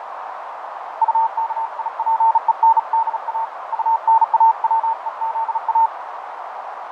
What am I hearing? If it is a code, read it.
Morse code, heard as a keyed tone, hand-sent with a bug key, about 36 wpm, 900 Hz, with radio static, fading and a narrow filter. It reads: UKIPENDA UNAWEZA